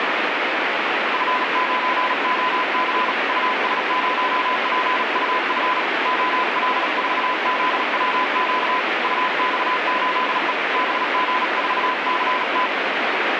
Morse code, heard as a keyed tone, hand-sent with a paddle, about 37 wpm, 1010 Hz, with heavy radio static. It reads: F9OC US0PUF OL4ZWQ UX8E BG4CT